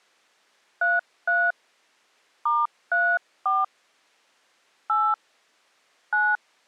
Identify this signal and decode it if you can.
DTMF, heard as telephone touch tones, dialled by hand, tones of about 240 ms. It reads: 33 *34 8 9